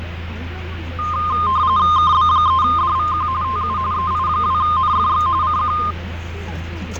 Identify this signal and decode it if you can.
RTTY (45.45 baud, 170 Hz shift), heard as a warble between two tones, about 1140 Hz centre, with radio static, fading and the noise inside a car. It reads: KB3DVQ TU EI2NFX CQ